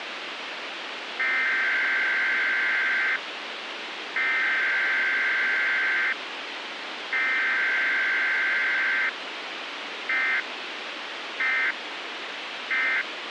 Emergency Alert System (SAME) tones (header bursts, then end-of-message bursts), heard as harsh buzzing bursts, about 520.83 baud, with radio hiss.